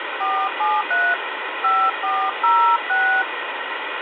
DTMF, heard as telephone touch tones, dialled by hand, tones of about 280 ms, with phone line noise. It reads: 473 5406